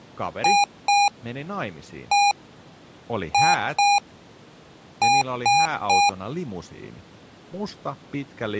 Beep code, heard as beeps from a small speaker, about 810 Hz, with speech in Finnish. 2-1-2-3. In Phoenix BIOS tables: ROM copyright notice check failure.